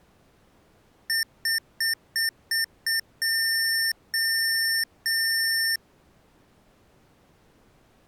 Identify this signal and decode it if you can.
Beep code, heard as beeps from a small speaker, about 1800 Hz. 6 short, 3 long.